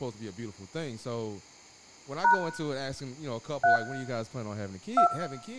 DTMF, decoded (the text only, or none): # 3 2